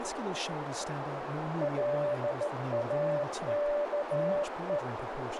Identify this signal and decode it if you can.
Morse code, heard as a keyed tone, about 14 wpm, 590 Hz, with radio static, a narrow filter and speech in English. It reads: LAKE